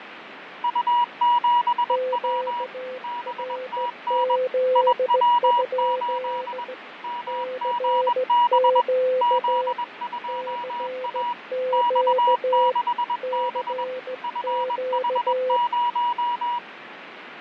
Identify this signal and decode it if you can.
Morse code, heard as two keyed tones, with radio static and fading. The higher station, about 21 wpm, 960 Hz: U7W BTN IW8 MGB Z2A X6B FH0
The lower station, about 16 wpm, 510 Hz: QRZ? CQ CQ CQ